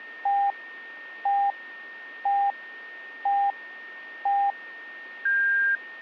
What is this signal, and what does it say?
Radio time signal (five pips and a higher one, as on Chinese radio), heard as pips, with a steady whistle near 1830 Hz.